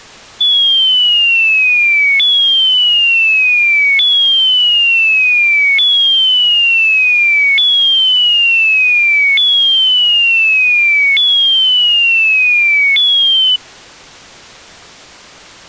A tone that sweeps in pitch again and again. There is no code.